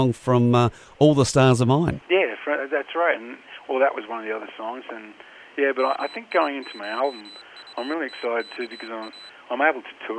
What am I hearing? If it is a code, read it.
Morse code (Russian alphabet), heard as a high beeper, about 23 wpm, 4000 Hz. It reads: МИШУТКА